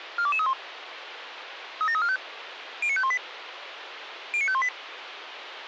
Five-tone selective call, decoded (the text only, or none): 42231 37345 09518 09518